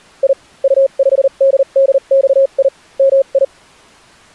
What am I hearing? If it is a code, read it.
Morse code, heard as a keyed tone, machine-sent, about 39 wpm, spaced as for 33 wpm, 540 Hz. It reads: I U5DDXI MI